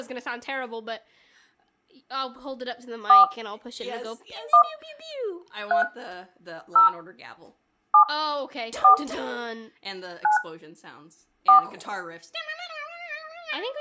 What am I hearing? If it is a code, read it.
DTMF, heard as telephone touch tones, dialled by hand, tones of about 110 ms. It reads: 4 1 3 0 7 4 9 4